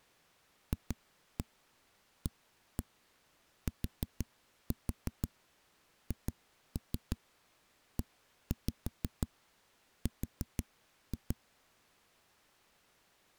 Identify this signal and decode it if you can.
Tap code, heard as knocks on a wall, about 6 knocks a second. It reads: FATHER